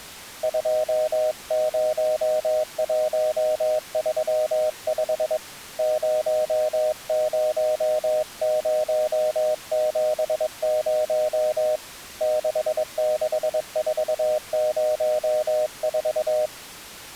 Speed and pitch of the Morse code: 22 wpm, 620 Hz

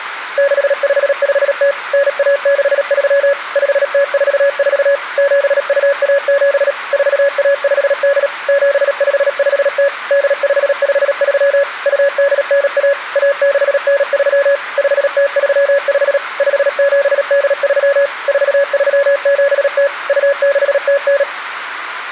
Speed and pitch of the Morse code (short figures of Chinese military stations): 37 wpm, 560 Hz

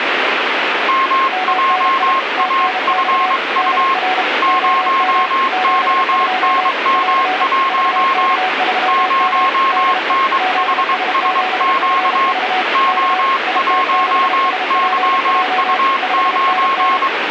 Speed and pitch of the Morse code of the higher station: 23 wpm, 1070 Hz

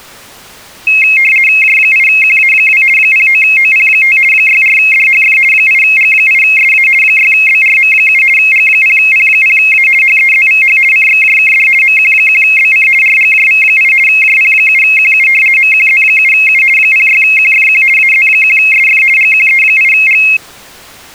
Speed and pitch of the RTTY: 50 baud, 450 Hz shift, 2350 Hz centre

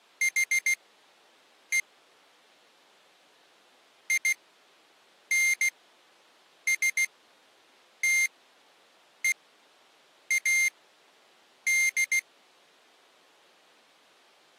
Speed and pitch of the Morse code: 16 wpm, spaced as for 7 wpm, 2100 Hz

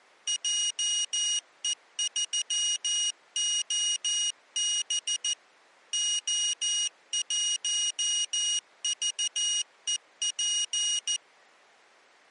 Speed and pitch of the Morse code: 14 wpm, 2900 Hz

